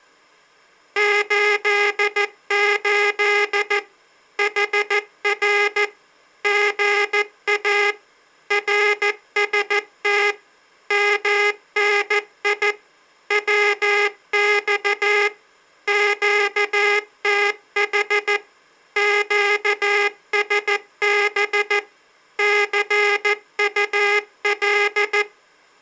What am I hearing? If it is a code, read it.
Morse code, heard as a buzzer, machine-sent, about 14 wpm. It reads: 88 HR GA RST MNI WX QTH QSB CUL